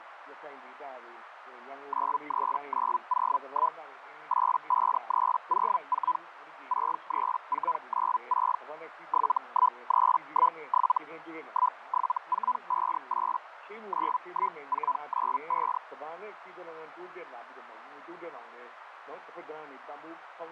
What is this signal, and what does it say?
Hellschreiber (Feld-Hell, 122.5 baud), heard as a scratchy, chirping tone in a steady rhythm, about 1000 Hz, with radio static and a narrow filter. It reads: 93901 85304 63496 71317 17458 91495